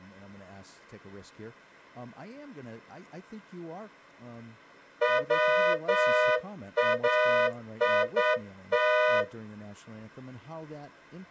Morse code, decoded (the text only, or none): WAIT